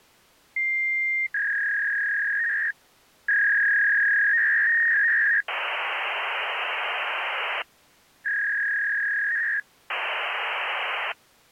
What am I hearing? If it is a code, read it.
Fax machine handshake, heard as a long tone, a warble and hiss.